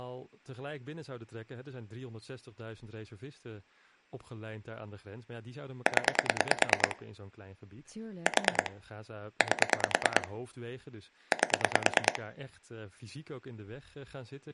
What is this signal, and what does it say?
Pulse dialling, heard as clicks on a phone line, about 9 pulses a second, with speech in Dutch. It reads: 0 4 8 8